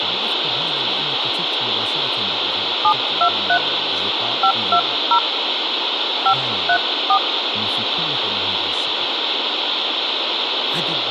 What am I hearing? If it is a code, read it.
DTMF, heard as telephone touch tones, dialled by hand, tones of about 80 ms, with radio hiss, a squelch burst at the end and speech in Arabic. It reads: 723 520 534